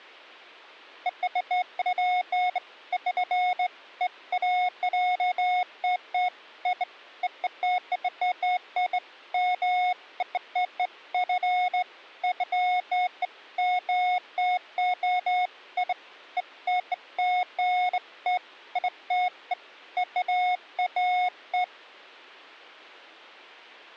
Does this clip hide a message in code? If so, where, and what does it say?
No, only beeps of irregular length.